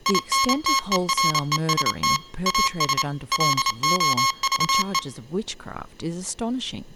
Morse code, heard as electronic beeps, machine-sent, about 28 wpm, 1080 Hz, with speech in English. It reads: INTEREST AS LOVE